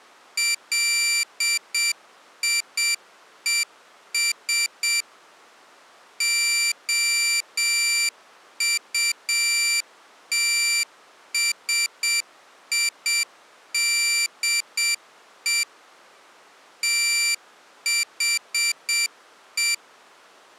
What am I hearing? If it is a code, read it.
Morse code, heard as a high beeper, machine-sent, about 7 wpm, 2350 Hz. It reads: LIES OUTSIDE THE